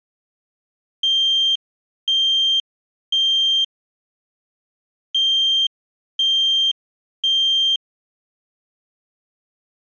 Alarm pattern, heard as an alarm's beeps, played twice, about 3150 Hz. Temporal three. Smoke or fire, evacuate.